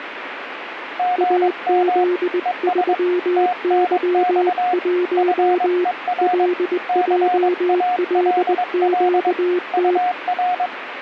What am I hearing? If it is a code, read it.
Morse code, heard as two keyed tones, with radio static. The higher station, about 22 wpm, 720 Hz: GM ES TNX FER CALL UR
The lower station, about 20 wpm, 360 Hz: AZ3Y1 LJLQT